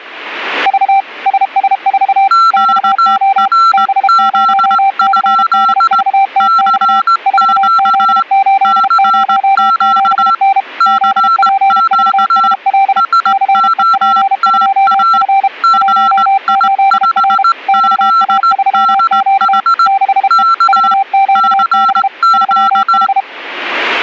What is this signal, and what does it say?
Morse code, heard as two keyed tones. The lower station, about 32 wpm, 780 Hz: V SS4 XO B0CDVTX 4Z807N ZPVSL CEP2F 18R XA3Q 6E VQB 3H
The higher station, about 18 wpm, 1350 Hz: QRZ? CQ CQ CQ SOTA GI5ZDH K CQ